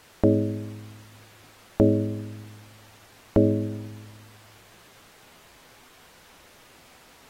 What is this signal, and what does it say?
Clock strike, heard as a bell. 3. Three o'clock.